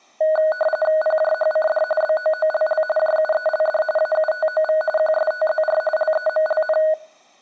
RTTY (45.45 baud, 850 Hz shift), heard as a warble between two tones, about 1050 Hz centre. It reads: PJHCD BOOLL JUELD AUTOV QSTZR LEMLN